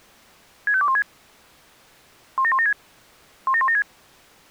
Five-tone selective call (ZVEI), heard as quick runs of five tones, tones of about 70 ms. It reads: 65216 17176 17176